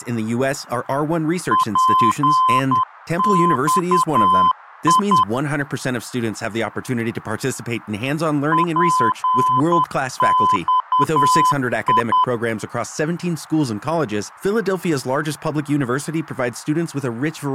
Morse code, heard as a keyed tone, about 10 wpm, 1020 Hz, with speech in Spanish. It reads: PXI PXI